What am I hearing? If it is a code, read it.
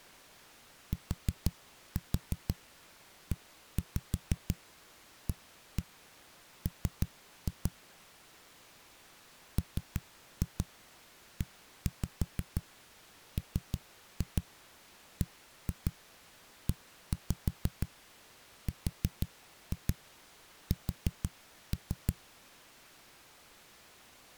Tap code, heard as knocks on a wall, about 6 knocks a second. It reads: TEAM MEMBERS